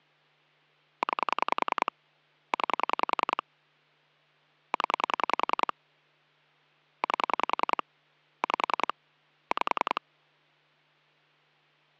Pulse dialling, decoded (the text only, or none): 9 9 0 8 5 5